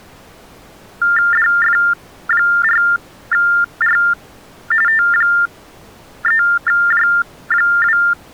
TTY/TDD text telephone tones (45.45 baud Baudot), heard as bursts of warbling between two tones, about 400 Hz shift, 1600 Hz centre. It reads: DF4R T3J2